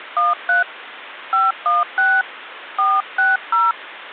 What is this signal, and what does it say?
DTMF, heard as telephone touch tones, dialled by hand, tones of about 190 ms, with phone line noise. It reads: 13 516 460